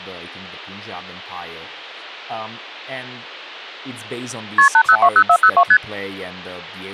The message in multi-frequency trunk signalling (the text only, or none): KP 8020402 ST